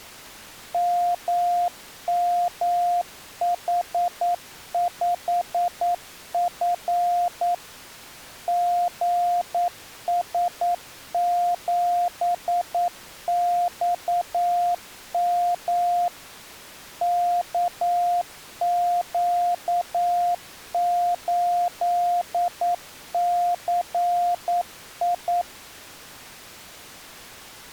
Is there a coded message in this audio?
Yes: Morse code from 0.7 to 25.5 s, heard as a keyed tone, machine-sent, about 9 wpm, 700 Hz. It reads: MMH5F GS7XM KQ8CI